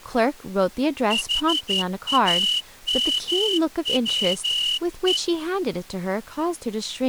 Morse code, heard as a whistle, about 12 wpm, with speech in English. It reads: HAMWE